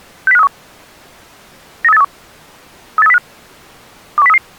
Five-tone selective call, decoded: 60531 93831 38305 21033

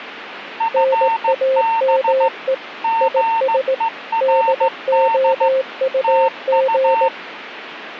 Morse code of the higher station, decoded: FB GERD TU

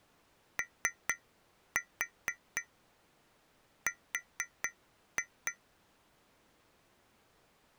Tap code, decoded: OR

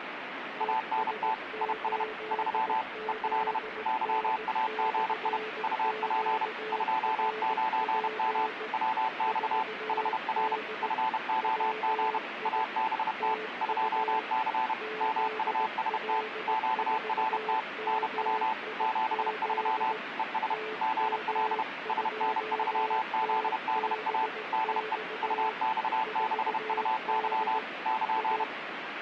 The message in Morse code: ANT IS 3 EL YAGI UP 29M WX HR FOG ABT 2C MUST QRT NW 73 ES GL SN3ZDA DE UX6UY <KN>

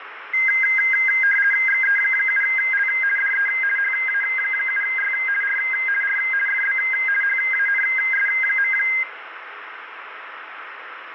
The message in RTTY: XE7L DE HA7Y R R FB HANS.

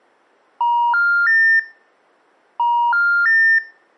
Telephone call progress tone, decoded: special information tone

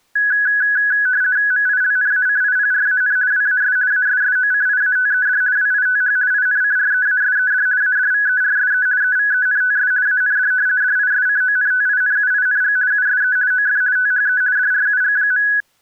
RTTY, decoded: MILNACIPRAN WAS ASSOCIATED WITH INCREASED ADVERSE EVENTS AND DISCONTINUING USE OF THE DRUG.

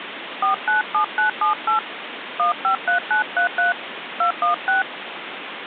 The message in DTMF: 497978 153933 216

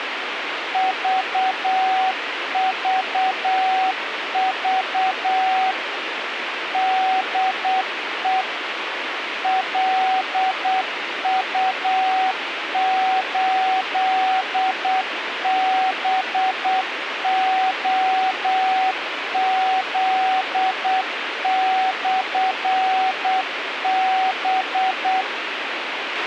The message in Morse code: VVV DE LU8BOZ/B

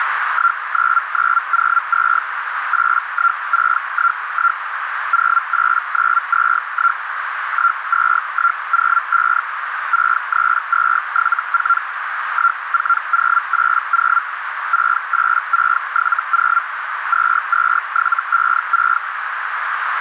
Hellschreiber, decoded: 19902 81611 08921 12105 63274 14080 68670 22756

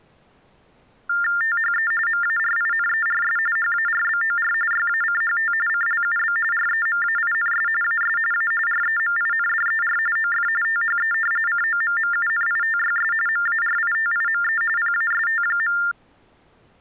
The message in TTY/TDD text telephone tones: THE MARINERS HARBOR YACHT CLUB REMAINS AS A REMINDER OF THE COMMUNITYS MARITIME PAST.

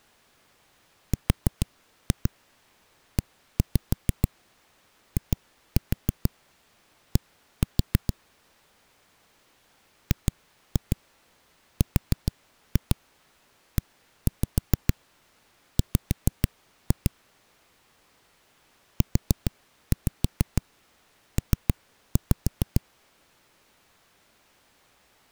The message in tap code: REID GREW UP

